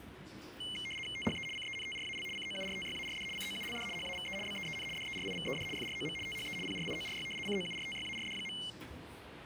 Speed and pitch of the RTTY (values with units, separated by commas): 75 baud, 850 Hz shift, 2550 Hz centre